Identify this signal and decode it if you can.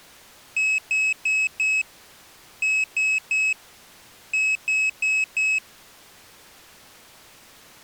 Beep code, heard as a piezo beeper, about 2550 Hz. 4-3-4. In Phoenix BIOS tables: time-of-day clock failure.